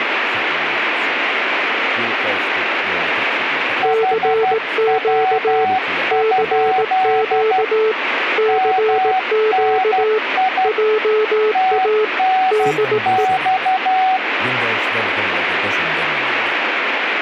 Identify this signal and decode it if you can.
Morse code, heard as two keyed tones, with radio static. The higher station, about 12 wpm, 750 Hz: HW? MNI TNX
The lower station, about 18 wpm, 440 Hz: CQ CQ CQ JA DE